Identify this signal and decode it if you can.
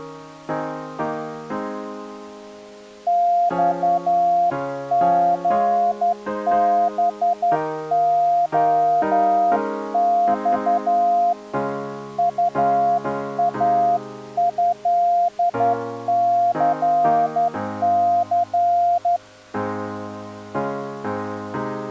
Morse code (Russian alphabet), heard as a keyed tone, hand-sent with a straight key, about 11 wpm, 700 Hz. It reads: ЬГБОЬ УАЭЦЦ